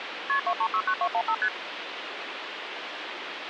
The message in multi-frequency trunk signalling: KP 2369215 ST

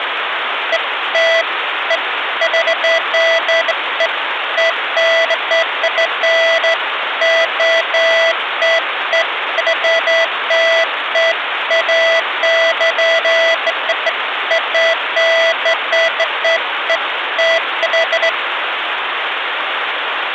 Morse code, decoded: none

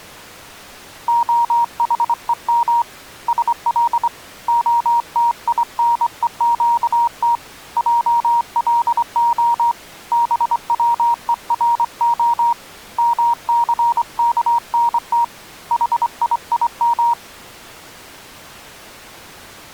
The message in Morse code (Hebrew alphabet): החום של התינוקת עלה בצורה מסכנת חיים

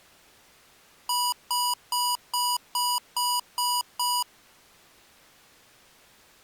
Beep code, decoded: 8 short

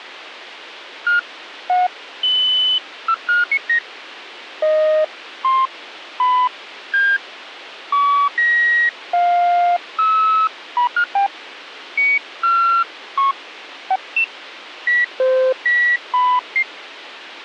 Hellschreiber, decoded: none

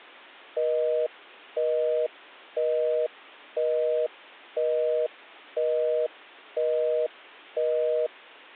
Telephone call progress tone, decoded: busy tone

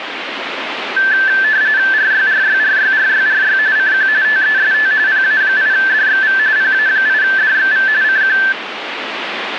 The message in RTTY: RYRYRYRYRY CQ TEST PA8DXV PA8DXV CQ

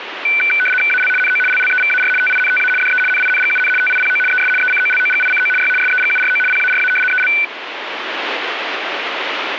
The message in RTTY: AL NO LLEVAR TINTA DE NINGUN TIPO ES ECOLOGICO Y SEGURO PARA EL

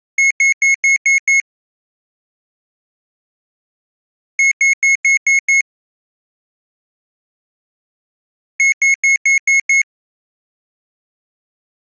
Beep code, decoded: 6 short

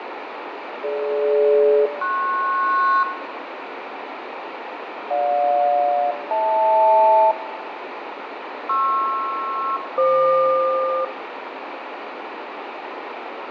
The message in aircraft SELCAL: DG-PS GJ-HL PR-FQ

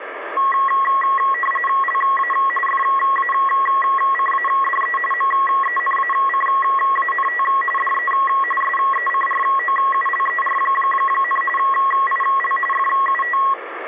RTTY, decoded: LA FACADE MENACANT DE SECROULER, IL FUT

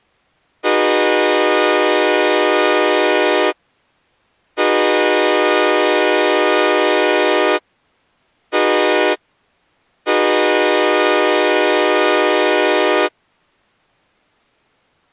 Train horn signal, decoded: 2 long, 1 short, 1 long

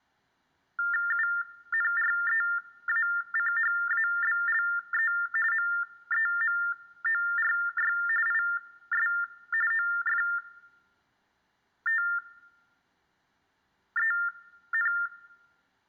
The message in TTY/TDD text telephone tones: UNREACHABLE MEMORY IS OFTEN

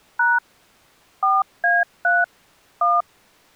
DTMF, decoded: # 4A3 1

